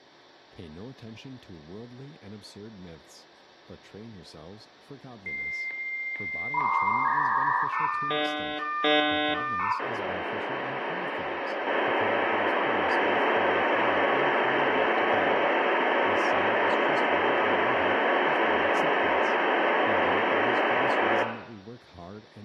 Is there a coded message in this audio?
Yes: dial-up modem handshake (V.34 or later) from 5.3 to 21.2 s, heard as a whistle, warbles, then hiss, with room echo and speech in English.